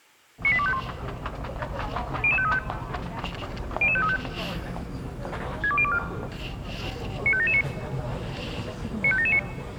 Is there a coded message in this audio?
Yes: five-tone selective call (ZVEI) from 0.4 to 9.4 s, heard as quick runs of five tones, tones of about 70 ms, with the noise of a crowd indoors. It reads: 98251 00535 00535 62024 95779 95779